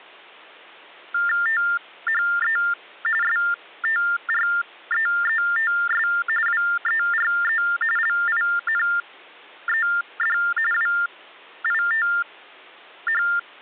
TTY/TDD text telephone tones (45.45 baud Baudot), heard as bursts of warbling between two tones, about 400 Hz shift, 1600 Hz centre. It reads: THE STREETS WERE LINED WITH